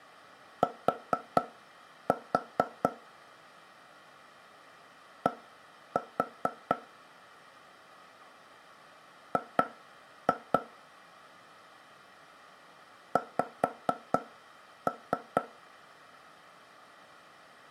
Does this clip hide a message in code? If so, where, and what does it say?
Yes: tap code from 0.6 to 15.4 s, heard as taps on a table, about 4 knocks a second, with room echo. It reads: T D G X